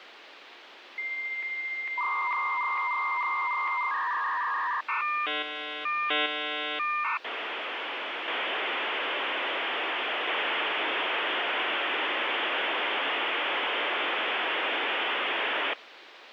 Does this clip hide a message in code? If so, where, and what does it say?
Yes: dial-up modem handshake (V.34 or later) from 1.0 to 15.7 s, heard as a whistle, warbles, then hiss, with phone line noise.